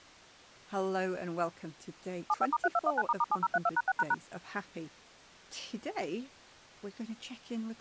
DTMF, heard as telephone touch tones, dialled by machine, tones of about 40 ms, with speech in English. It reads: 75*3219**7032#6##